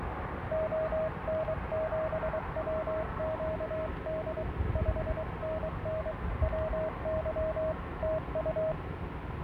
Morse code, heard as a keyed tone, hand-sent with a paddle, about 23 wpm, 630 Hz, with radio static, a weaker station near 1280 Hz and street noise. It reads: ON7WQD 5NN WY TU